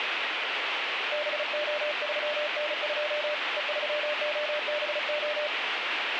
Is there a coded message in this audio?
Yes: Morse code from 1.1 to 5.5 s, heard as a keyed tone, hand-sent with a paddle, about 35 wpm, 600 Hz, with radio static. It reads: BO3N2 E3OBO